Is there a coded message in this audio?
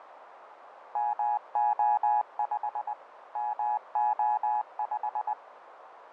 Yes: Morse code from 0.9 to 5.4 s, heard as a keyed tone, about 20 wpm, 840 Hz, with radio static and a narrow filter. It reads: MO5 MO5